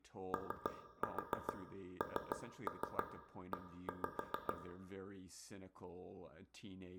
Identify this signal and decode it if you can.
Tap code, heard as taps on a table, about 6 knocks a second, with room echo and speech in English. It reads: ONE